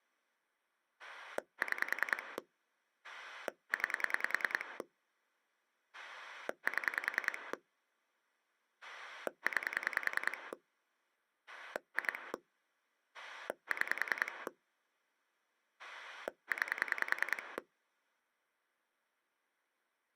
Pulse dialling, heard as a rotary dial, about 10 pulses a second. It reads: 6 9 7 9 2 6 9